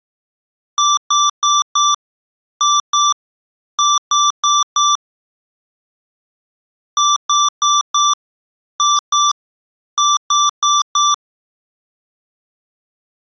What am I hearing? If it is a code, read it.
Beep code, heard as beeps from a small speaker, played twice, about 1170 Hz. 4-2-4. In Phoenix BIOS tables: unexpected interrupt in protected mode.